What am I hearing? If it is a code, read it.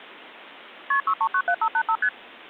Multi-frequency trunk signalling (R1, as on North American trunks), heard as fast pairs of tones, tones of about 70 ms. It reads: KP 6397585 ST